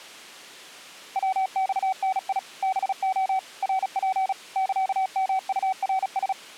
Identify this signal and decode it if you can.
Morse code (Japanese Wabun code), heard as a keyed tone, machine-sent, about 36 wpm, 760 Hz. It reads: ヤマダ ハレ ナツ サヨウナラ